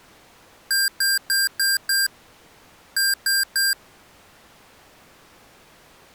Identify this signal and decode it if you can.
Beep code, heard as beeps from a small speaker, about 1600 Hz. 5-3.